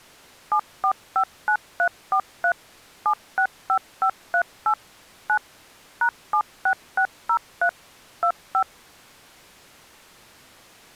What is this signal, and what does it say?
DTMF, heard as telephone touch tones, dialled by machine, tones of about 80 ms. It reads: 7459343 765538 9 #76603 25